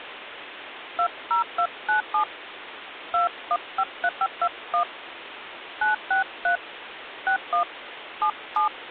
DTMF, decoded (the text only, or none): 20297 2153521 963 61 77